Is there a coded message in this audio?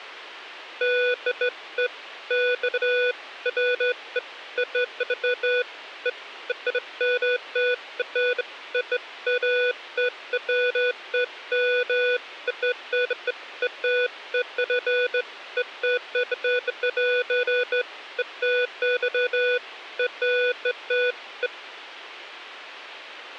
No, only beeps of irregular length.